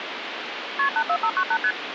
Multi-frequency trunk signalling (R1, as on North American trunks), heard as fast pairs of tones, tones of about 70 ms, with phone line noise. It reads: KP 84598 ST